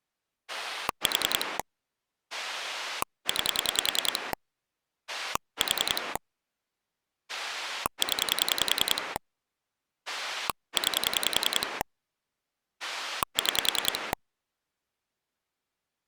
Pulse dialling, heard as a rotary dial, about 10 pulses a second. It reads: 4 9 4 0 9 6